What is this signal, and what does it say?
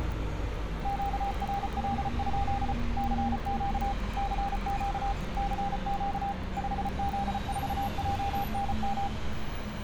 Morse code, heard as a keyed tone, machine-sent, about 34 wpm, 800 Hz, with street noise. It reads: QRL? CQ CQ CQ 5Z4JNM